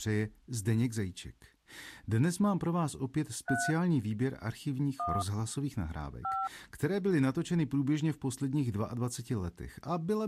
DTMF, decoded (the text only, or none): 3 1 5